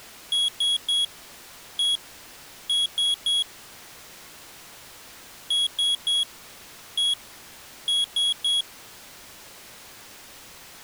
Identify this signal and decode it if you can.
Beep code, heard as a piezo beeper, played twice, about 3350 Hz. 3-1-3. In Phoenix BIOS tables: interrupt mask register failure.